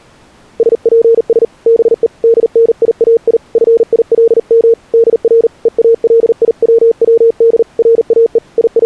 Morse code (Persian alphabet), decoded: سپس به دنیای فیلم در هالیوود راه …

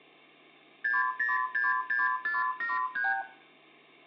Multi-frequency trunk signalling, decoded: 6066473

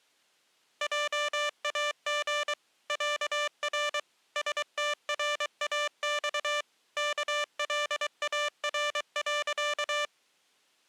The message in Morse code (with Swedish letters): JAG ÄR STRAX KLAR.

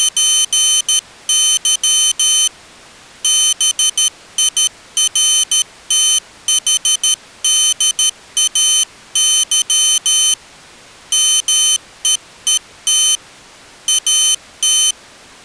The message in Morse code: … BIRTHDAY MEET AT

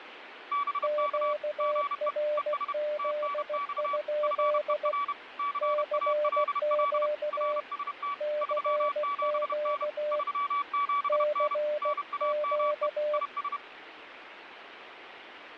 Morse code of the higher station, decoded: BK GE ES TNX FER CALL RST 37N 37N NAME IS

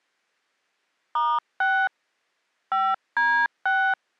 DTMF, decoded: *6 5D6

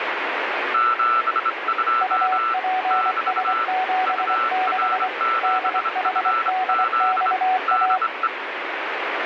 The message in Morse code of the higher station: 72 <BT> UR7FZ DE

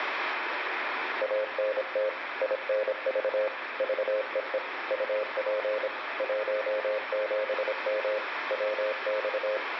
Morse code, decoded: ANT INV VEE UP 17M WX

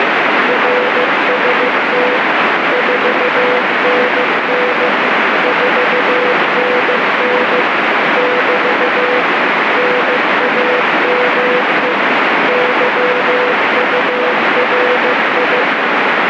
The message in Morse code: RST 4NN 4NN <BT> NAME YURI

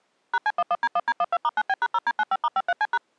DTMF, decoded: #C11D1D12*9B#0D95*53C#

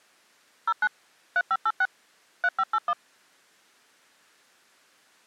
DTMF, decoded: 09 3586 3581

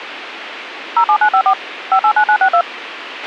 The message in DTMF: 07954 589962

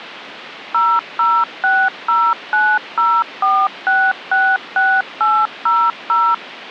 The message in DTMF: 0060904666800

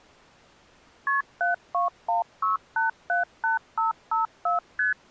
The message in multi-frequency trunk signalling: KP 7216878554 ST

